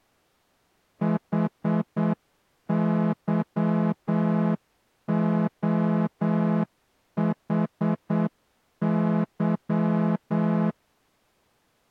Morse code, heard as a horn, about 8 wpm. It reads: HYOHY